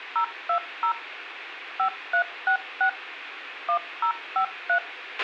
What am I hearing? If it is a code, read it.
DTMF, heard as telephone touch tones, dialled by machine, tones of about 90 ms, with radio hiss, a squelch burst at the end and room echo. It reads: 020 5366 1053